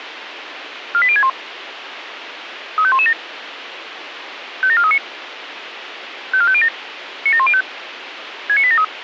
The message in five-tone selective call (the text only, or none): 48061 35117 57439 54507 97105 69873